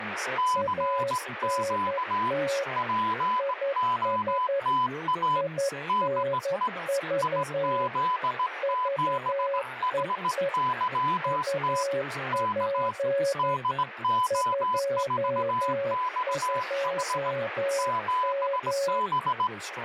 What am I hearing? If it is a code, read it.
Morse code, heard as two keyed tones, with radio static and speech in English. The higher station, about 18 wpm, 1000 Hz: CQ POTA DE IZ7HYT K DO4XH 7B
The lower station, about 11 wpm, 550 Hz: ANT IS INV VEE UP 22M